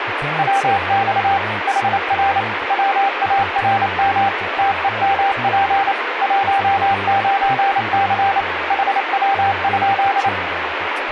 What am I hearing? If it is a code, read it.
Morse code, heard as a keyed tone, machine-sent, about 28 wpm, 790 Hz, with radio static and speech in English. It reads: WX HR WARM TEMP 19C HW?